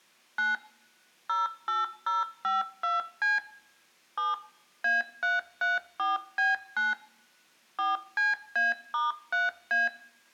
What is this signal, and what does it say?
DTMF, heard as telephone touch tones, dialled by machine, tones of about 170 ms, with room echo. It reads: 9 08052C 7 A334B9 4CA*3A